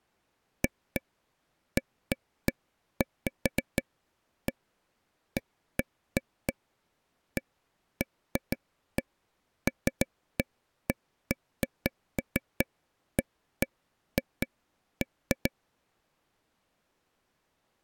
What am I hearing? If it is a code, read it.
Irregular taps on a table. There is no code.